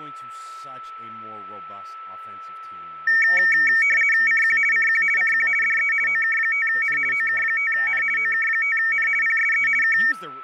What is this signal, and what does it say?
RTTY (50 baud, 450 Hz shift), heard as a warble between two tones, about 2050 Hz centre, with a steady whistle near 1320 Hz and speech in English. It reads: CQ CQ CQ DE OK5N OK5N OK5N PSE K